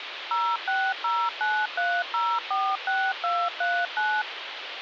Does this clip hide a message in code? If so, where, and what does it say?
Yes: DTMF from 0.3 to 4.2 s, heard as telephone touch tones, dialled by machine, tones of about 250 ms, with phone line noise. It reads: 06093046239